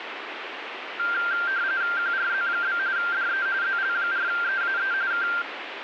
RTTY (45.45 baud, 170 Hz shift), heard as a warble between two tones, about 1480 Hz centre, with radio static. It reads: QRZ? DE ZL4EAE K